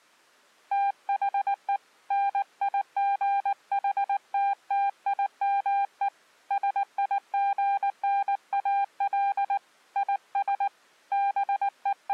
Morse code, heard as a keyed tone, hand-sent with a paddle, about 19 wpm, 800 Hz. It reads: THE NIGHTTIME SIGNAL IS …